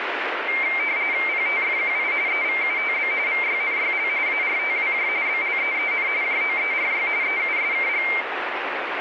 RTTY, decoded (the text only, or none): PTFQI EVUTB VYNYL ARTWJ BLEEN JOERY EUSKG